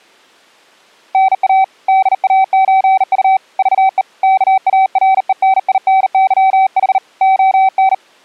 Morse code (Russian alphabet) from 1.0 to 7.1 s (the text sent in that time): НА ДАЧУ ЖЕ КАРЕНИНЫХ